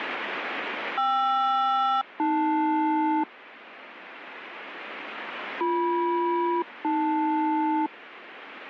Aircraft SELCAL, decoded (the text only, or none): KR-AL BM-AL